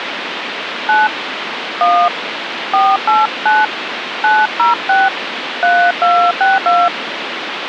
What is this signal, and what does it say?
DTMF, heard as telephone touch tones, dialled by hand, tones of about 200 ms, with phone line noise. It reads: 9 1 489 906 3262